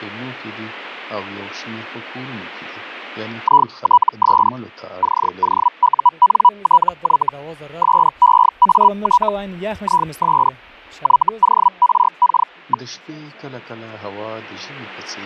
Hellschreiber (Feld-Hell, 122.5 baud), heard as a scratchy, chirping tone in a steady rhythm, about 980 Hz. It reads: ITS COUNTY SEAT IS YORK.